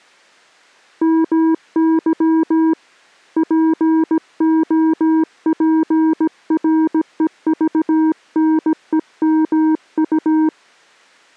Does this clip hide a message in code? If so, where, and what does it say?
Yes: Morse code (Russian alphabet) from 1.0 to 10.5 s, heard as a keyed tone, hand-sent with a paddle, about 17 wpm, 320 Hz. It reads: МЫ ПОПРЕЖНЕМУ